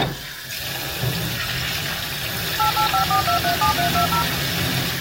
DTMF, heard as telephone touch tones, dialled by machine, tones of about 100 ms, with kitchen noise. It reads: 8854237320